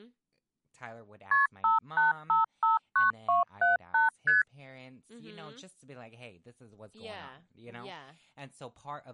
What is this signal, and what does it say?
Multi-frequency trunk signalling (R1, as on North American trunks), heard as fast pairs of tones, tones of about 150 ms, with speech in English. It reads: KP 58559278 ST